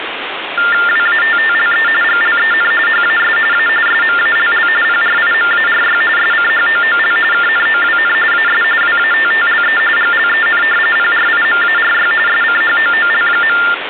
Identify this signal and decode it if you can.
TTY/TDD text telephone tones (45.45 baud Baudot), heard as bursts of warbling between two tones, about 400 Hz shift, 1600 Hz centre, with phone line noise. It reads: WATTLE GLEN HAS A SMALL PRIMARY SCHOOL KNOWN AS WATTLE GLEN PRIMARY SCHOOL.